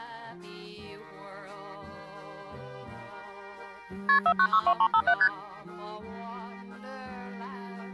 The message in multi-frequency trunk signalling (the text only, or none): KP 4962357 ST